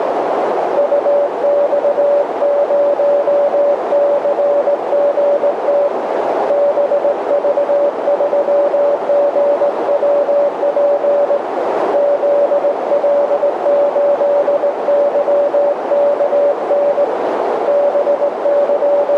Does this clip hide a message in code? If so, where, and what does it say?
Yes: Morse code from 0.7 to 19.2 s, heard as a keyed tone, hand-sent with a straight key, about 18 wpm, 570 Hz, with heavy radio static and a narrow filter. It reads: UX0CGT BV3GWP ZL8YKN …